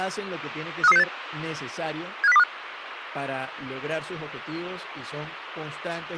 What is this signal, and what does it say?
Five-tone selective call (EEA), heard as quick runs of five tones, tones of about 40 ms, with radio hiss and speech in Spanish. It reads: 53368 75025